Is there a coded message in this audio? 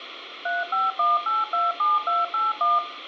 Yes: DTMF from 0.5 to 2.8 s, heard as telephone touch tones, dialled by machine, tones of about 180 ms, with radio hiss and room echo. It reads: 351827281